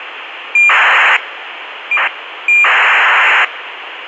ACARS aircraft data, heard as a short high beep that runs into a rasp, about 2400 baud, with radio hiss.